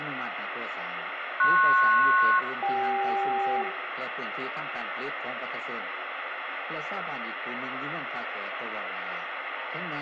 Aircraft SELCAL, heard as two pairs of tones, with radio static and room echo. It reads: PS-CK